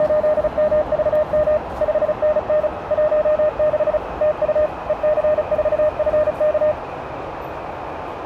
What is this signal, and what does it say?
Morse code, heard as a keyed tone, machine-sent, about 35 wpm, 610 Hz, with radio static, a narrow filter and the noise inside a subway train. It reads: … 5NN 16 TU EC4FK